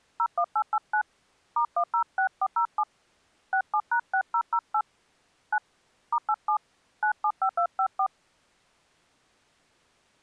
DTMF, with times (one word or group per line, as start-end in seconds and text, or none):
0.2-1.0 01889
1.6-2.8 *106407
3.5-4.8 67#6008
5.5-5.6 9
6.1-6.6 *87
7.0-8.1 975254